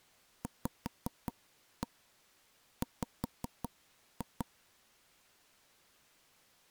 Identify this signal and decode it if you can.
Tap code, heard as taps on a table, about 5 knocks a second. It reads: VW